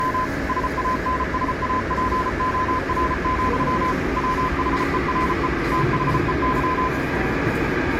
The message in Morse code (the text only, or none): … SANSAPOR, WHERE THEY